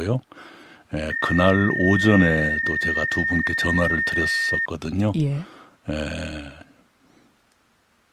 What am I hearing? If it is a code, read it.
PSK31 (31.25 baud), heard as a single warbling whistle, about 1850 Hz, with speech in Korean.